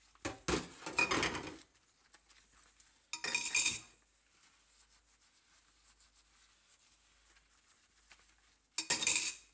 Kitchen noise. There is no code.